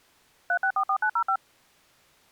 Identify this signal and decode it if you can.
DTMF, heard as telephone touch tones, dialled by machine, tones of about 80 ms. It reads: 3644905